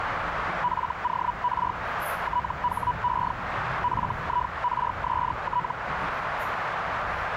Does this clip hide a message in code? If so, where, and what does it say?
Yes: Hellschreiber (Feld-Hell, 122.5 baud) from 0.6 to 5.7 s, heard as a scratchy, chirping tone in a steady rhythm, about 980 Hz, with radio static, a narrow filter and the noise inside a subway train. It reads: FOR THE FIRST